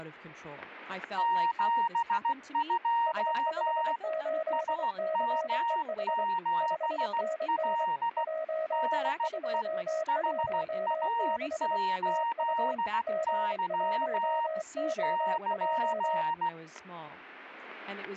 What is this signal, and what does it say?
Morse code, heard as two keyed tones, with static crashes and speech in English. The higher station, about 16 wpm, 930 Hz: 72 SM7L DE HA8Y <KN>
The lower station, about 24 wpm, 640 Hz: S58CEH 5NN 1216 TU G1OJ